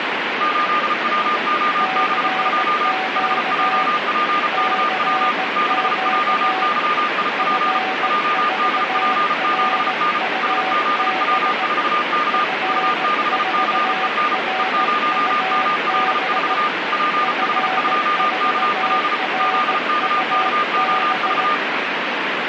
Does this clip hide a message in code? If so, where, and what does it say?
Yes: Morse code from 0.3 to 21.6 s, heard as two keyed tones, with radio static. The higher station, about 34 wpm, 1210 Hz: 8WOB2 HJPKW 6JYIP JDP7N SZW4K U6CEN E0ML4 PH2KL ZKKOV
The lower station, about 17 wpm, 760 Hz: CQ CQ F4RUB F4RUB F4RUB